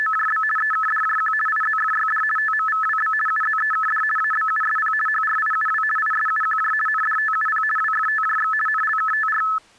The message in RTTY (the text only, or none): … EKDJQ IZFYD TMVWB UZEKD ABUSP HRIUW ISUQJ NDTUP WFTJX NLKTR